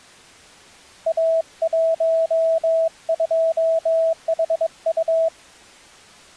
Morse code, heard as a keyed tone, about 22 wpm, 650 Hz. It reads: A12HU